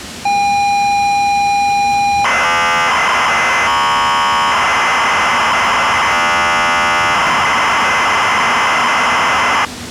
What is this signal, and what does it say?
ZX Spectrum tape loading, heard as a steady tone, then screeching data, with the noise of a subway station.